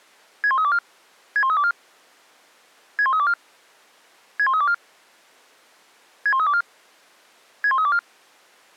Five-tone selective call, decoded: 61324 61324 61324 61324 61324 61324

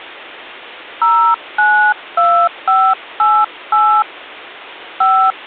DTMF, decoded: 092588 5

